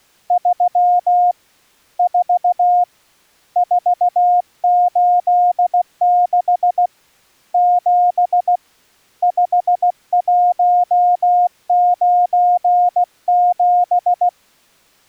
Morse code, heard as a keyed tone, hand-sent with a paddle, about 16 wpm, 710 Hz. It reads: 3 4 486 7 5197